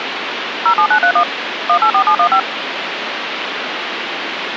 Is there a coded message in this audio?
Yes: DTMF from 0.7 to 2.4 s, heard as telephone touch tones, dialled by machine, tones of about 80 ms, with phone line noise. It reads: 07931 184715